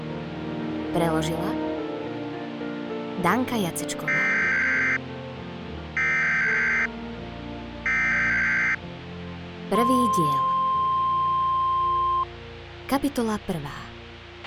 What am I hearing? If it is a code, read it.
Emergency Alert System (SAME) tones (header bursts, then the 1050 Hz attention tone), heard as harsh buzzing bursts, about 520.83 baud, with a squelch burst at the end.